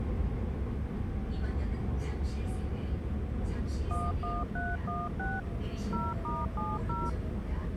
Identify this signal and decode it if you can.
DTMF, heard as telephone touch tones, dialled by machine, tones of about 200 ms, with the noise inside a subway train. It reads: 11316 0*70